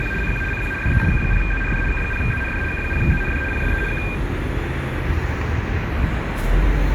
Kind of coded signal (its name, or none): RTTY